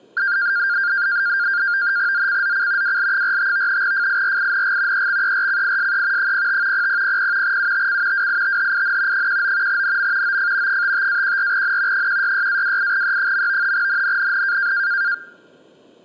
NAVTEX (SITOR-B), 100 baud, 170 Hz shift, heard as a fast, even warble, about 1500 Hz centre. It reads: ZCZC WL45 FIRING EXERCISE 05 0000 UTC WITHIN 19 NM OF 55-14N 166-28E. NNNN